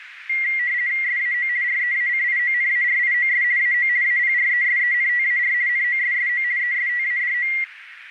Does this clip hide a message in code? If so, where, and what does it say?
Yes: RTTY (50 baud, 170 Hz shift) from 0.3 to 7.6 s, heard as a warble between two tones, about 2050 Hz centre, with radio static and a narrow filter. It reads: SAO REACIONARIOS AO APRESENTAR NOSSO ESTADO